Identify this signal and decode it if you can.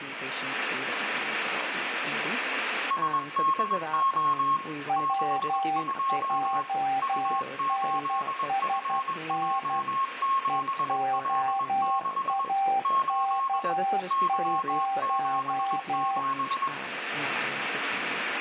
Morse code, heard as two keyed tones, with radio static and room echo. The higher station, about 21 wpm, 1080 Hz: SDO 62 U8FJ7L6 8 Y77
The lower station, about 12 wpm, 780 Hz: WJNSN EOAK0